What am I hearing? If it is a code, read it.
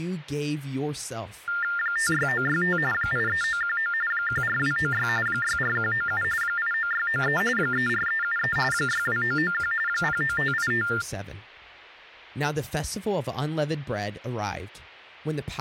TTY/TDD text telephone tones (45.45 baud Baudot), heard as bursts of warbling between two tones, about 400 Hz shift, 1600 Hz centre, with speech in English. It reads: 56965 83919 14296 64197 89693 34373 62991 09585